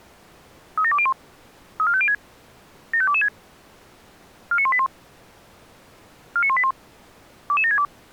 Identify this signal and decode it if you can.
Five-tone selective call (ZVEI), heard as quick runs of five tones, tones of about 70 ms. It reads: 37201 34506 75226 49181 49181 22762